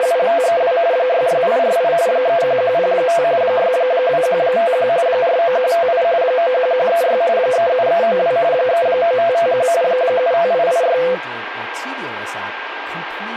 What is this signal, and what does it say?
RTTY (45.45 baud, 170 Hz shift), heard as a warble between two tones, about 590 Hz centre, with radio static, a steady whistle near 1600 Hz and speech in English. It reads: … 66848 31105 62151 49158 91136 37392 39551 75886